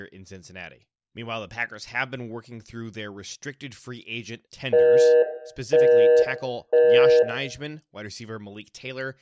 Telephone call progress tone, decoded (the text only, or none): busy tone